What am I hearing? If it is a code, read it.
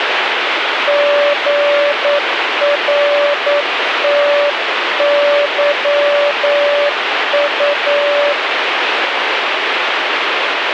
Morse code, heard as a keyed tone, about 9 wpm, 580 Hz, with radio static. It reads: GRTYU